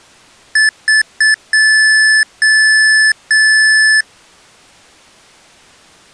Beep code, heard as beeps from a small speaker, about 1750 Hz. 3 short, 3 long.